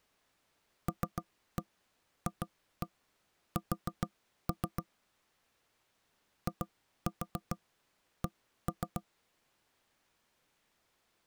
Tap code, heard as knocks on wood, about 7 knocks a second. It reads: LFS IC